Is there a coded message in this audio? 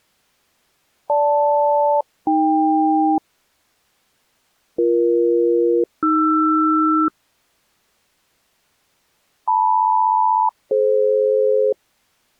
Yes: aircraft SELCAL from 1.1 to 11.7 s, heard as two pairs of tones. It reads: GL-AK BE-AR LM-DF